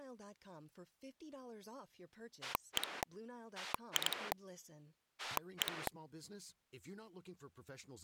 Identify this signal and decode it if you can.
Pulse dialling, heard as a rotary dial, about 10 pulses a second, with speech in English. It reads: 1 2 1